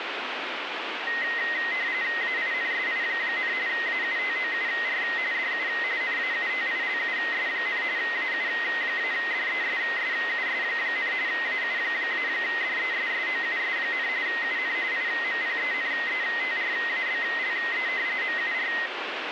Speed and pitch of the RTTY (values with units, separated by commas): 45.45 baud, 170 Hz shift, 1950 Hz centre